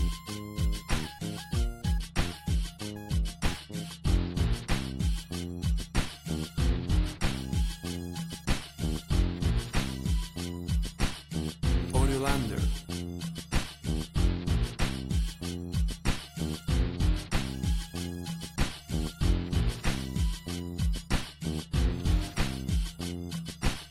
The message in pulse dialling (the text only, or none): none